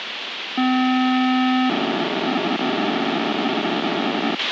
POCSAG pager data (512 baud), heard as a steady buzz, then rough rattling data, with radio hiss and a squelch burst at the end.